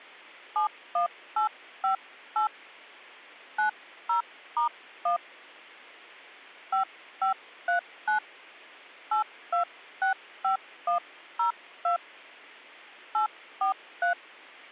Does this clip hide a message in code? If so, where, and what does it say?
Yes: DTMF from 0.6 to 14.1 s, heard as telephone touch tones, dialled by hand, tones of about 110 ms. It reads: 71858 90*1 5539 8265102 843